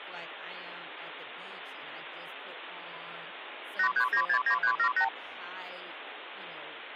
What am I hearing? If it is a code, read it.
Multi-frequency trunk signalling (R2, with the far end's replies), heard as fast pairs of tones, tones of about 80 ms, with phone line noise and speech in English. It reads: 83969378